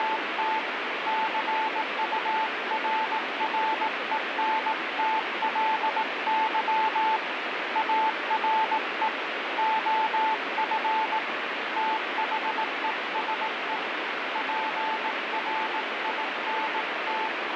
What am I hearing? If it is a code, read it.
Morse code, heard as a keyed tone, hand-sent with a paddle, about 18 wpm, 880 Hz, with heavy radio static. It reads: … CURRENTLY ARE OF THESE PRINT